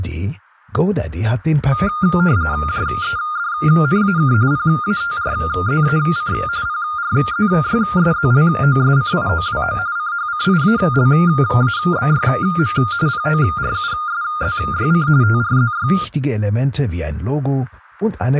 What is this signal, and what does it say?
RTTY (45.45 baud, 170 Hz shift), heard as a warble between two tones, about 1310 Hz centre, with static crashes. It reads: JEDNAK PATRZAC PRZYSZLOSCIOWO CHCIALABYM PORUSZYC TRZY